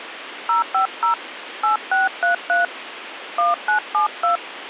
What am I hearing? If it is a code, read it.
DTMF, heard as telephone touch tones, dialled by hand, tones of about 130 ms, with phone line noise. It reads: 050 8633 1972